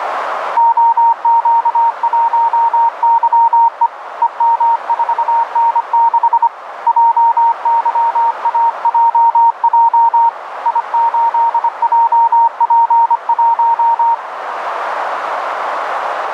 Morse code, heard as a keyed tone, hand-sent with a paddle, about 25 wpm, 930 Hz, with radio static and a narrow filter. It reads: OQ1YE EM4N6 JYAJJ I8JP1